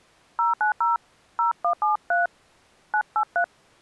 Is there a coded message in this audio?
Yes: DTMF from 0.4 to 3.4 s, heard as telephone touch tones, dialled by hand, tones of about 120 ms. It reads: 090 0173 983